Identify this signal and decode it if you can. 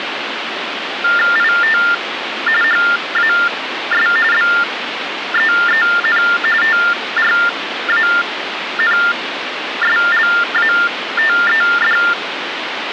TTY/TDD text telephone tones (45.45 baud Baudot), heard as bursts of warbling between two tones, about 400 Hz shift, 1600 Hz centre, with phone line noise. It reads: IT HAS BEEN TRANSLATED